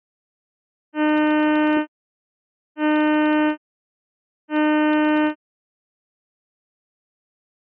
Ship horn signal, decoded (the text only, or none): 3 short